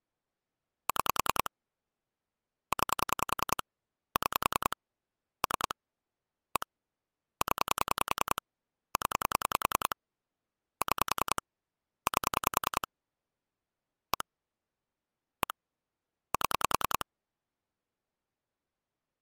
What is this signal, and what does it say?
Pulse dialling, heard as clicks on a phone line, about 10 pulses a second. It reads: 6 9 6 3 1 0 0 6 8 1 1 7